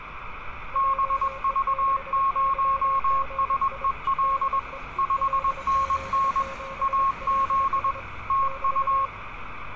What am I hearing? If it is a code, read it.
Morse code, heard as two keyed tones, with radio static and street noise. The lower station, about 25 wpm, 540 Hz: JE6YGI DE LZ7LS <BT>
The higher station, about 21 wpm, 1090 Hz: BV0SEL 5NN AZ TU